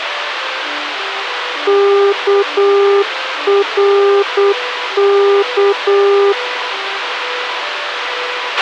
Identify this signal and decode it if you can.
Morse code, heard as a keyed tone, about 8 wpm, 400 Hz, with radio hiss and a squelch burst at the end. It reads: KRK